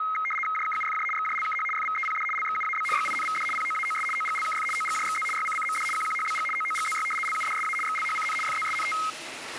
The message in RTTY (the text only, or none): JKUFJ XJLKH FVEPD LXUAB GINVD POAOS OGLKF OGJXZ YCCMD QQHBG OOGZY LUDSA XLHCN FZSNT